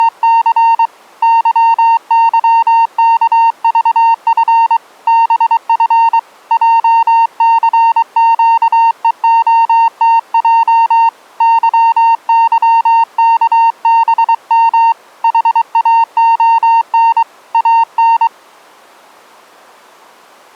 Morse code, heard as a keyed tone, hand-sent with a paddle, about 23 wpm, 920 Hz. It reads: … YYKVF BF JCQEOTJ YYKBM HAON AN